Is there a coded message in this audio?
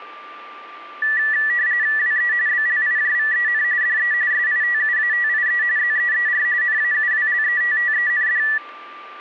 Yes: RTTY (45.45 baud, 170 Hz shift) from 1.0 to 8.6 s, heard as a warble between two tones, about 1850 Hz centre, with a steady whistle near 1180 Hz. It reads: WE BLIJVEN DE SITUATIE ZEER NAUWLETTEND